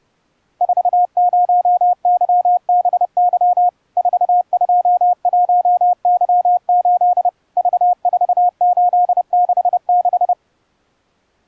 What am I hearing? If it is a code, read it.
Morse code, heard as a keyed tone, machine-sent, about 30 wpm, 720 Hz. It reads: 40YBY 421Y8 V4866